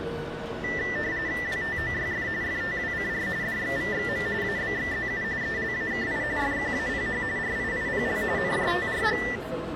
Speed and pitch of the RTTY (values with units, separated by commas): 45.45 baud, 170 Hz shift, 1900 Hz centre